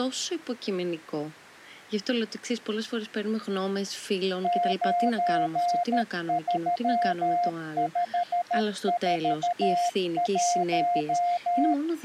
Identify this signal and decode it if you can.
Morse code, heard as a keyed tone, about 13 wpm, 700 Hz, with speech in Greek. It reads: 93541